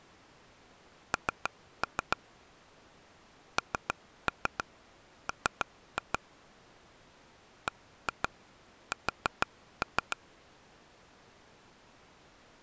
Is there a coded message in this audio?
Yes: tap code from 1.1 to 10.1 s, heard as taps on a table, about 6 knocks a second. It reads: N NM BS